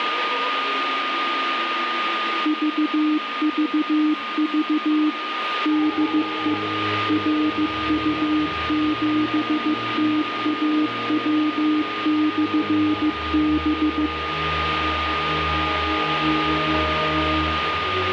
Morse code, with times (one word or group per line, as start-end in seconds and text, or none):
2.5-5.1 VVV
5.7-6.5 DE
7.1-14.1 RU7TAW/B